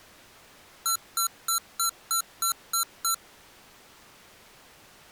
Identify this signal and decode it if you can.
Beep code, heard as beeps from a small speaker, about 1350 Hz. 8 short. In AMI BIOS tables: display memory failure; in Dell tables: LCD failure.